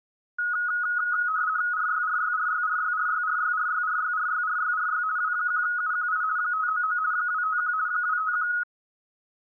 RTTY (50 baud, 170 Hz shift), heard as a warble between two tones, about 1360 Hz centre. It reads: RYRYRYRYRYRYRYRYRYRYRY W1UQI 599 251 251